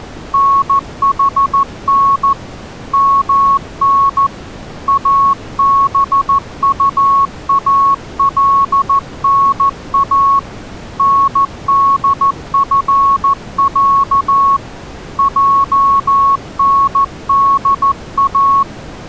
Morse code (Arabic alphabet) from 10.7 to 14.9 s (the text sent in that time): ندفع